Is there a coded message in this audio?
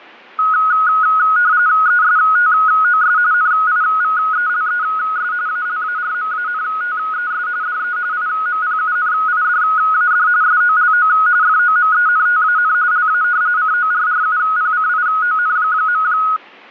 Yes: RTTY (45.45 baud, 170 Hz shift) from 0.4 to 16.4 s, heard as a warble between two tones, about 1360 Hz centre. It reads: ESTOS NIVELES ALARMANTES DE IMPUNIDAD SOLO FOMENTAN LA CORRUPCION.